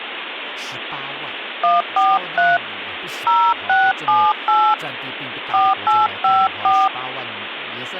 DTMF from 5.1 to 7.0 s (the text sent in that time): 4854